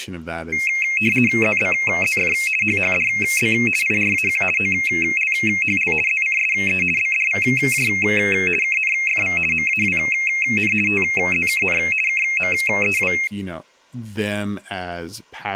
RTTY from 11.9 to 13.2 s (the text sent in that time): KMEW